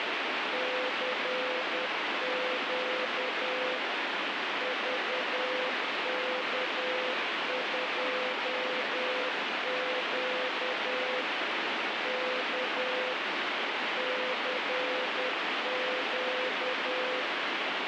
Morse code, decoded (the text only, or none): CQ VK2Q K CQ